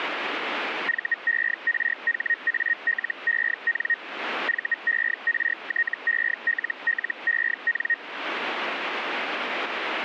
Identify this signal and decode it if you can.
Hellschreiber (Feld-Hell, 122.5 baud), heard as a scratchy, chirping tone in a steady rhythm, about 1850 Hz. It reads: VERHALEN VERTELLEN